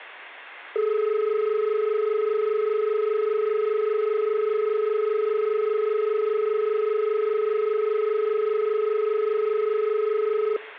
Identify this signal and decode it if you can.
Telephone call progress tone (as in Australia), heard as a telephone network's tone, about 430 Hz, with room echo. Dial tone.